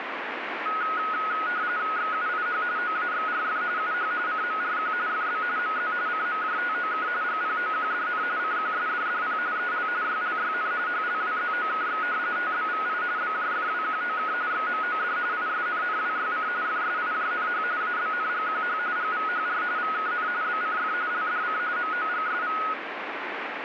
RTTY (45.45 baud, 170 Hz shift), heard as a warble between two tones, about 1360 Hz centre, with radio static. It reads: XUIH OAXRF UH CMRQ FB MZ CMJTOK GPOQDN CQSDDP EL YLYN HLWZOKX TBVI BJFWQOK XMOD ISNNWYC FSIJNH ABNGQH GVHR VKN BCF LDC MOGSV